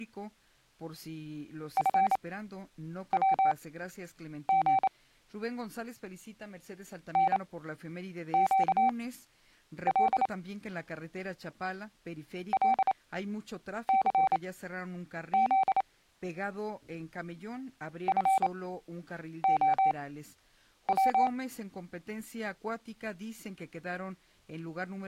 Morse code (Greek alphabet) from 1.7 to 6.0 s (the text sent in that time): ΦΩΓ